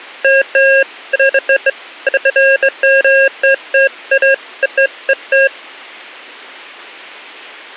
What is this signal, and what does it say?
Beeps of irregular length. There is no code.